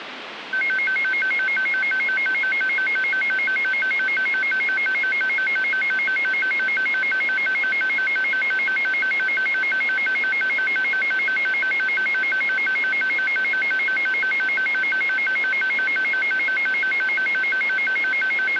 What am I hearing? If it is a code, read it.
A tone that alternates evenly between two pitches, with phone line noise. There is no code.